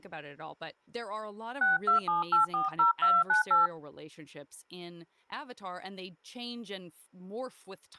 DTMF, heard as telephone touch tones, dialled by hand, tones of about 160 ms, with speech in English. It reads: 627840298